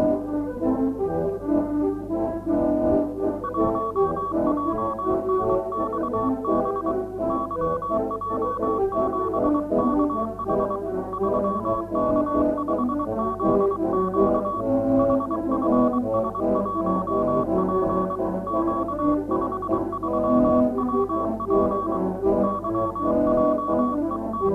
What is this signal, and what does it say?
Morse code, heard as a keyed tone, hand-sent with a paddle, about 23 wpm, 1130 Hz. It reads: 1JNXB YJ7KH 3K5ZQ HFS1P Q53WP …